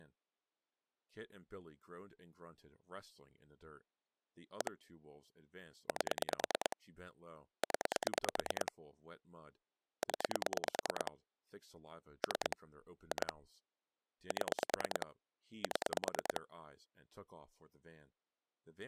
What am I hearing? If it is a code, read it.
Pulse dialling, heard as clicks on a phone line, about 9 pulses a second, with speech in English. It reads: 1 8 0 0 3 2 7 7